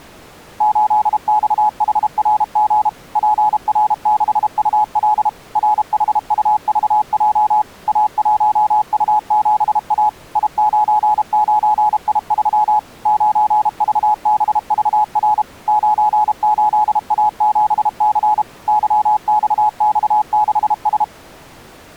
Morse code, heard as a keyed tone, machine-sent, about 32 wpm, 850 Hz. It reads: 8XHRG PR6UL RHUVJ A1U7A I99I3 9VBVR 98A7C YXX6S